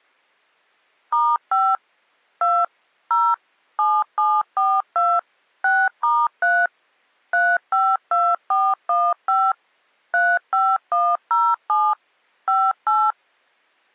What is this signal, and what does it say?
DTMF, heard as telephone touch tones, dialled by machine, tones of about 240 ms. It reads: *5 2 0 7742 6*3 352415 35107 58